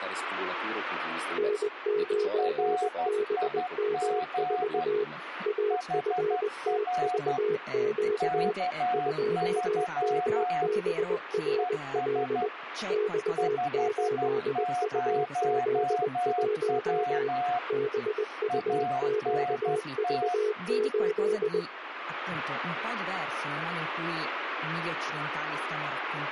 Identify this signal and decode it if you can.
Morse code, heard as two keyed tones, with radio static and speech in Italian. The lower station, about 20 wpm, 420 Hz: N9BM4 AFTVQ 2MBRL X8UZ1 BUQV8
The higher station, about 12 wpm, 720 Hz: RIG HR K3 ES 50W ANT